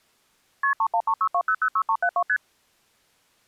Multi-frequency trunk signalling (R1, as on North American trunks), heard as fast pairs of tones, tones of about 70 ms. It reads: KP 31362006372 ST